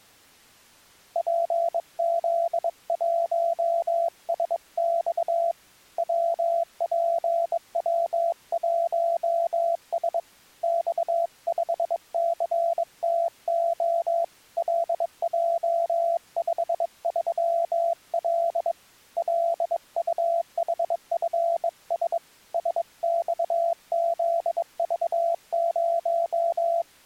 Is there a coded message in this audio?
Yes: Morse code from 1.1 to 26.9 s, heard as a keyed tone, hand-sent with a bug key, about 22 wpm, 680 Hz. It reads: PZ1SX WPW1S X5CTO LJ53L LUHFS SXZV0